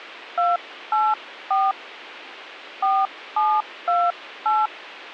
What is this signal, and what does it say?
DTMF, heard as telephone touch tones, dialled by hand, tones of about 210 ms. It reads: 284 4728